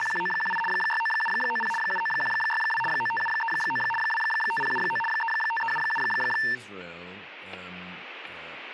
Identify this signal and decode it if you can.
RTTY (75 baud, 850 Hz shift), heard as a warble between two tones, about 1340 Hz centre, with radio static, static crashes and speech in English. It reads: … 69790 79162 95739 25079 35377